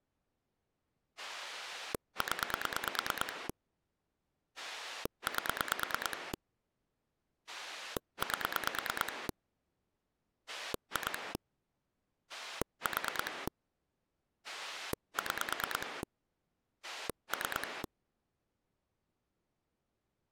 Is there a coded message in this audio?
Yes: pulse dialling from 1.2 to 17.9 s, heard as a rotary dial, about 9 pulses a second. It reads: 0 8 8 2 4 6 3